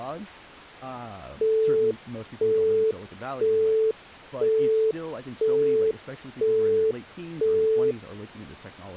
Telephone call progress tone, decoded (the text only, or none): busy tone